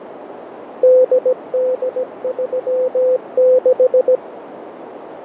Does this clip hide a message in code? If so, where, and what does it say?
Yes: Morse code (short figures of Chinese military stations) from 0.8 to 4.2 s, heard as a keyed tone, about 17 wpm, 510 Hz, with radio static, fading and a narrow filter. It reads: 8836